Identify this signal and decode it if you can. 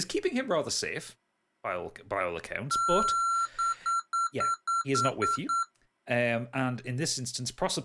Beep code, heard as beeps from a small speaker, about 1360 Hz, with speech in English. 1 long, 8 short. In AMI BIOS tables: display or retrace test failure.